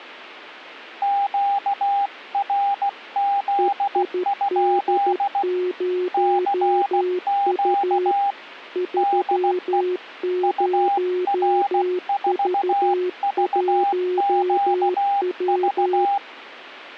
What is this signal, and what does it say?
Morse code, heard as two keyed tones. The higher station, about 16 wpm, 800 Hz: QRZ? CQ DE UR4VQV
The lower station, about 13 wpm, 360 Hz: EID0U 30V1W